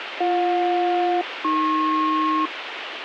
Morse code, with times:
none

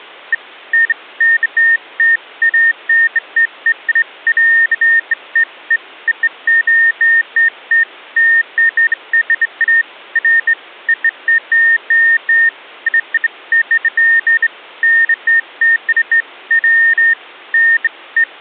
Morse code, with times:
none

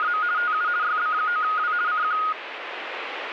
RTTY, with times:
0.0-0.2 …
0.4-0.7 TU
0.8-1.7 YB9W
1.9-2.2 CQ

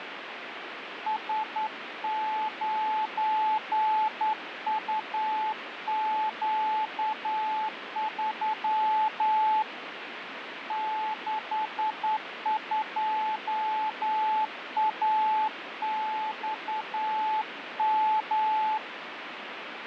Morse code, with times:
1.1-9.6 S9UQ3
10.7-18.8 62AXM

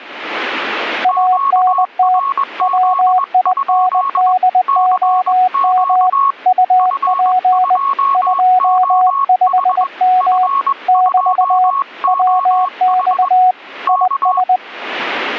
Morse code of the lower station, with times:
1.0-2.2 ANT
2.6-6.1 WINDOM
6.5-7.8 UP
8.1-10.5 25M
10.9-11.7 <BT>
12.1-13.5 WX
13.9-14.6 IS

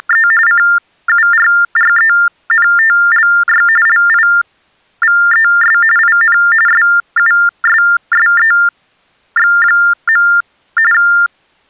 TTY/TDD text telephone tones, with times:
0.0-0.3 …
0.5-3.7 CURRENTLY
3.9-5.8 LIVES
6.0-6.4 IN
6.7-10.3 SUSSEX.
10.9-11.7 …

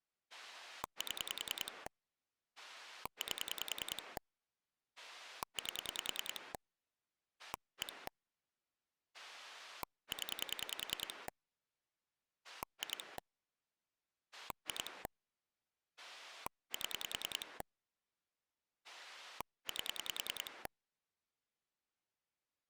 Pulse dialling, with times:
0.3-1.9 7
2.6-4.2 8
5.0-6.5 8
7.4-8.1 1
9.1-11.3 0
12.4-13.2 2
14.3-15.1 2
16.0-17.6 7
18.8-20.7 8

